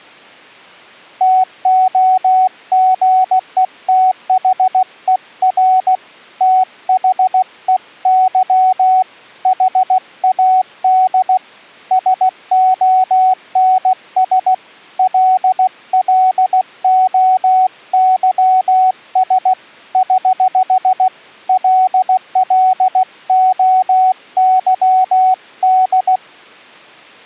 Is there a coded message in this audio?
Yes: Morse code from 1.1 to 26.2 s, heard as a keyed tone, hand-sent with a paddle, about 16 wpm, 750 Hz. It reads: TOGETHER THEY HAD SONS LLOYS <HH> LLOYD